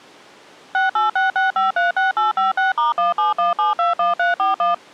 DTMF, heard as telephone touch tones, dialled by machine, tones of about 150 ms. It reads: 6866536856*171721341